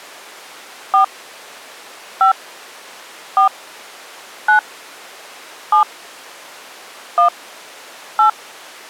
DTMF, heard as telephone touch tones, dialled by hand, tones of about 110 ms. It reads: 4 5 4 9 7 1 8